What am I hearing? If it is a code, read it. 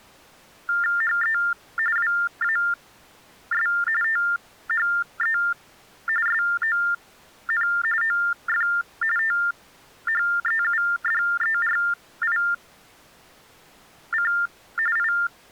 TTY/TDD text telephone tones (45.45 baud Baudot), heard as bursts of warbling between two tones, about 400 Hz shift, 1600 Hz centre. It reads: HE WAS THE SON OF THEUDERIC I